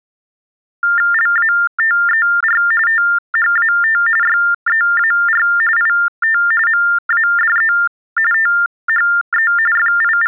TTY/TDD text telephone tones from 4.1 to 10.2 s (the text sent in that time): YEAR IT MADE THE …